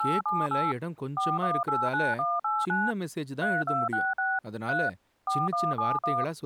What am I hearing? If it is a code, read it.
DTMF, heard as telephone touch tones, dialled by machine, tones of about 210 ms, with speech in Tamil. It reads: 878 4189189 3266 3 4171